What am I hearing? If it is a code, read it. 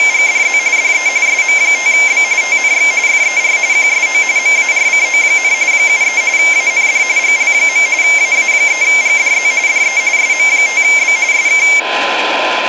RTTY (45.45 baud, 170 Hz shift), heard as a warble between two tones, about 2200 Hz centre, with radio static and a steady whistle near 1020 Hz. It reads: … DE SM5B TNX FER QSO MARCO, 73 AND GL. AA3GDZ DE SM5B SK